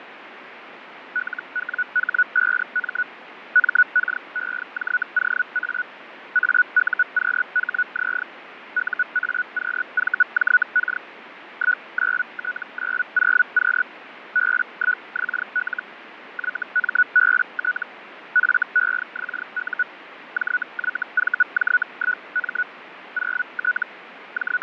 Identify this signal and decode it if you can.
Hellschreiber (Feld-Hell, 122.5 baud), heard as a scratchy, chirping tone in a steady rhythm, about 1470 Hz, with radio static and fading. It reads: LWH5M MKEJOA AUQHZ UAQVJK 19T90Q B1XL YMBT FEXU JYVJ1M 0T …